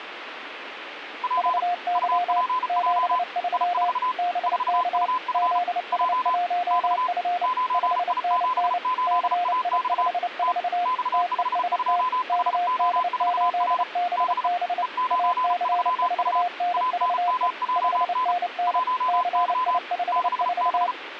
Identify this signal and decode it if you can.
Morse code, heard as two keyed tones, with radio static. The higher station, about 35 wpm, 1010 Hz: P UPJ I4 4UF J X 9I78AX T X52HO4R B E93U ANMJN 1Y 6B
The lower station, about 29 wpm, 710 Hz: VY 73 BK ZS1F 5NN CI54 TEST KD8BB AC4NVE 5NN CI54